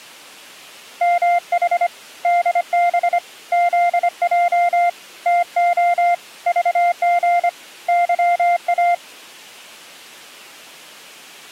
Morse code, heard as a keyed tone, hand-sent with a paddle, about 25 wpm, 700 Hz. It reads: MH DB ZJ TO VG YA